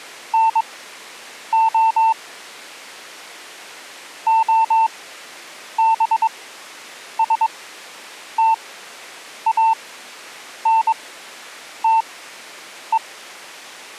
Morse code, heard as a keyed tone, machine-sent, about 22 wpm, spaced as for 8 wpm, 900 Hz. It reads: NO OBSTANTE